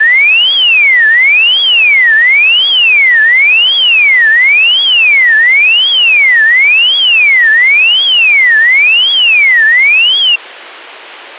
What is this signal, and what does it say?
A tone that sweeps in pitch again and again. There is no code.